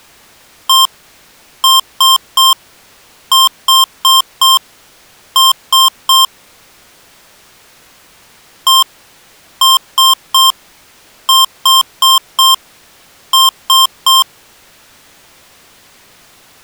Beep code, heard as beeps from a small speaker, played twice, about 1060 Hz. 1-3-4-3. In Phoenix BIOS tables: memory failure on data bits.